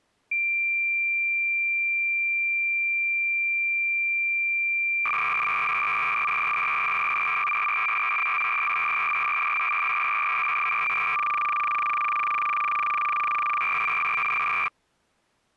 Cassette data (Kansas City type), 300 baud, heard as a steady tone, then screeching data.